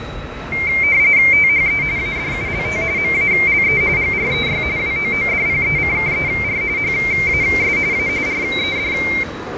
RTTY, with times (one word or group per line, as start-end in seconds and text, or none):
1.3-1.8 THE
2.0-2.8 ADULT
3.0-3.8 MALE
4.0-4.6 GREY
4.8-6.6 WOODPECKER
6.8-7.8 HAS
7.9-8.1 A
8.3-8.9 RED